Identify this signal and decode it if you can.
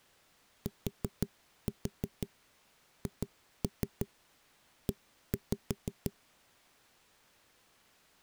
Tap code, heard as knocks on a wall, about 6 knocks a second. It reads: THE